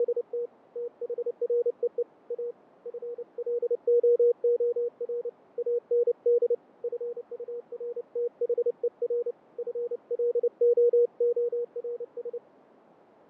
Morse code, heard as a keyed tone, hand-sent with a paddle, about 29 wpm, 480 Hz, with radio static and fading. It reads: … THREE A FLOOR AND FURTHER FLOORS